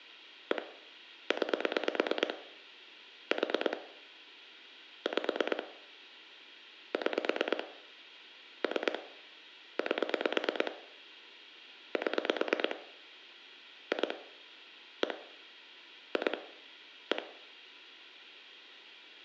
Pulse dialling, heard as clicks on a phone line, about 9 pulses a second, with room echo. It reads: 1 9 4 5 6 3 8 7 2 1 2 1